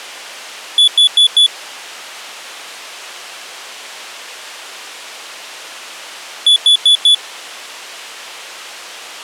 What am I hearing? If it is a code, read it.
Alarm pattern, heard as an alarm's beeps, played twice, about 3450 Hz. Temporal four. Carbon monoxide.